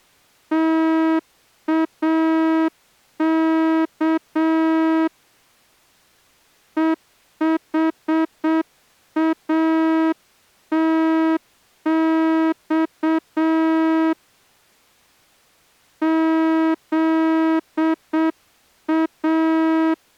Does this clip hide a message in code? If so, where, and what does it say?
Yes: Morse code (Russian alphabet) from 0.5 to 20.0 s, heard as a horn, hand-sent with a straight key, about 7 wpm. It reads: ТАК ЕХАТЬ ЗА